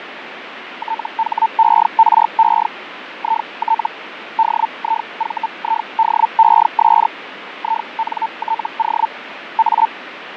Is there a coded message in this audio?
Yes: Hellschreiber (Feld-Hell, 122.5 baud) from 0.8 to 9.9 s, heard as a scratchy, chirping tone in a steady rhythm, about 900 Hz, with radio static and fading. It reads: THERE IT DIVIDES INTO A